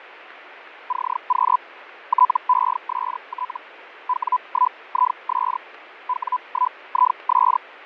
Hellschreiber (Feld-Hell, 122.5 baud), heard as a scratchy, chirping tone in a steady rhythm, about 1000 Hz, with radio static and fading. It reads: CQ TEST W1IS W1IS